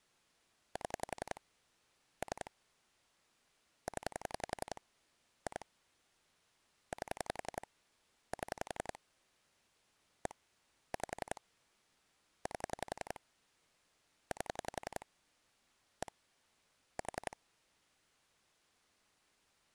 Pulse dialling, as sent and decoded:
7 / 3 / 10 / 2 / 8 / 7 / 1 / 5 / 8 / 8 / 1 / 4
7 3 0 2 8 7 1 5 8 8 1 4

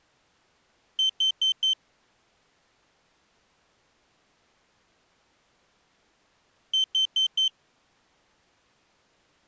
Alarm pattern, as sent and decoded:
4 beeps and a pause
temporal four

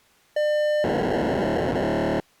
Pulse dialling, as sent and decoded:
none

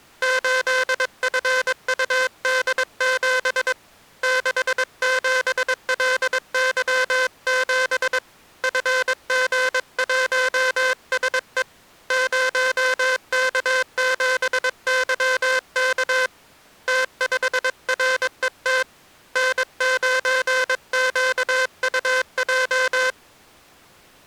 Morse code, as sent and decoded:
---.. ..-. ..- -.. --... / -.... --... .-.. -.-- --... / ..-. --. .---- ... . / ----- -.- --... -.-- -.- / - ..... .-. . - / -. ----. --.- ..- .---
8FUD7 67LY7 FG1SE 0K7YK T5RET N9QUJ

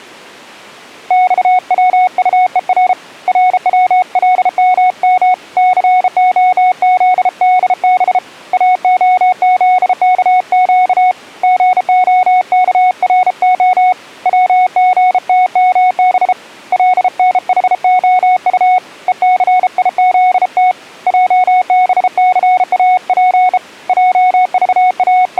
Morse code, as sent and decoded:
-..- .-- ..- . .-. / .-. .-- .-.. -- -- / -.-. --- --.. -.. -... / .- --- --.. -.- --.- / --. --- -.- .-. --- / .-- --. - -- -... / .-.. -. .... --- ..- / . -.-. .. --.. - / .--- -... -.-. .- .--. / …
XWUER RWLMM COZDB AOZKQ GOKRO WGTMB LNHOU ECIZT JBCAP …

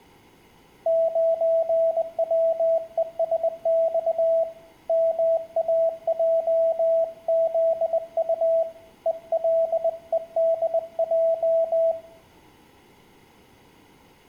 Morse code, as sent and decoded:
----. .-- . ... -..- / -- .- .--- --.. ..- / . .-.. . -.. .---
9WESX MAJZU ELEDJ

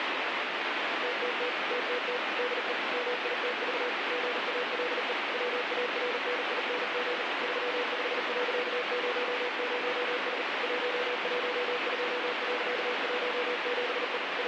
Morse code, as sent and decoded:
- - - / - - - / -.. . / -- .. - ...- / --. .- .-.. . / .-- .- .-. -. .. -. --. / ...-- ..... .-.-.- ----- ----- ... / .---- .---- ..--- .-.-.- .---- --... . / …
TTT TTT DE MITV GALE WARNING 35.00S 112.17E …

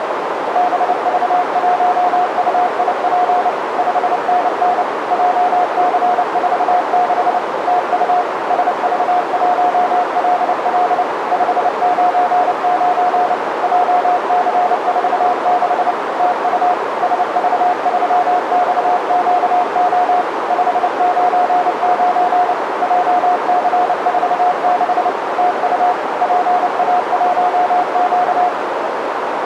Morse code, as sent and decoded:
-... ...- .---- ..- .. .--. / ..... -. -. / .--- -.-. ....- -.... / - ..- / ... ...- .---- .-.. .-.. / ..... ----. ----. / .--- -.-. ....- -.... / - ..- / ... ...- ...-- -..- --.- --- / ..... ----. ----. / .--- -.-. ....- -.... / - ..- / .--. .- .---- --.-
BV1UIP 5NN JC46 TU SV1LL 599 JC46 TU SV3XQO 599 JC46 TU PA1Q

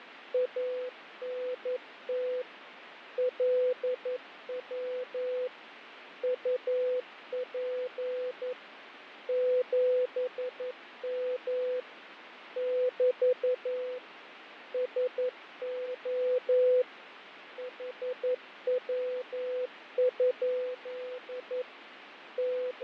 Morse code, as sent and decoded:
.- -. - / .-.. .-- / ..- .--. / --... -- / -...- / ... --- / .... .-- ..--.. / …
ANT LW UP 7M <BT> SO HW? …

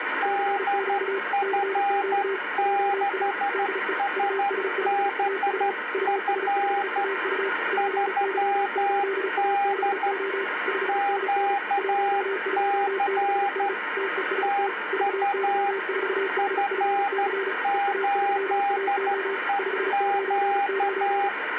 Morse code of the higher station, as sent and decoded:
-.. ..-. -.... ... -... ..-. / ...-- -.. / --.- -.-. / - ..- / ..-. ---.. . --.-
DF6SBF 3D QC TU F8EQ

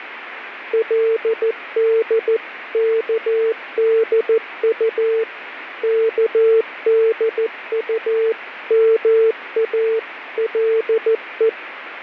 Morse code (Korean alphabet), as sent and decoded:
.-.. -.. -.- -.. ..- / -.- -.. ..- -- .- .-.. .
그의 의모가

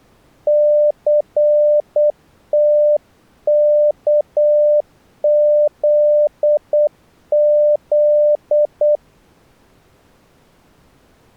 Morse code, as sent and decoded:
-.-. - -.- --.. --..
CTKZZ

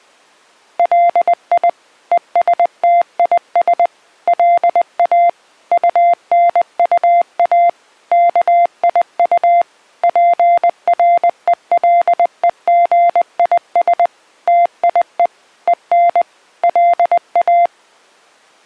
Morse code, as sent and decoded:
.-.. .. / . ... - .. ... / .-.. .- / ..- -. ..- .- / -.- .. ..- / .--. .-. . .-.. . --. .. ... / - .. . / . -. / .-.. .-
LI ESTIS LA UNUA KIU PRELEGIS TIE EN LA

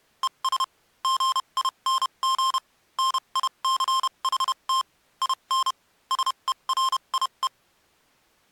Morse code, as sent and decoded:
. ... / --. .. -. --. / -. .. -.-. .... - / .. -. / ... . .-. .. .
ES GING NICHT IN SERIE

